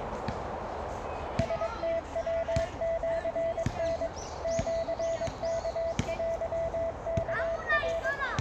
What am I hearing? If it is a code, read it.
Morse code (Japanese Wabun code), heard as a keyed tone, machine-sent, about 22 wpm, 660 Hz, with radio static, a narrow filter and the noise of a residential street. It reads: ラムヤシタ シワテワナ